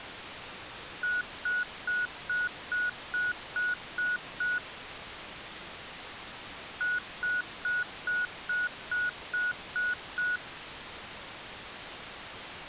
Beep code, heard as beeps from a small speaker, played twice, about 1460 Hz. 9 short. In AMI BIOS tables: ROM checksum failure.